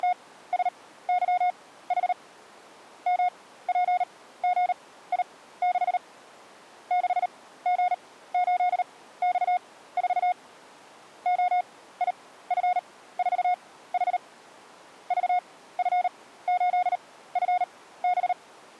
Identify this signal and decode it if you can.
Morse code, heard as a keyed tone, machine-sent, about 38 wpm, spaced as for 17 wpm, 720 Hz. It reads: … MPGI6 6G8X4 OIF4H VF8FB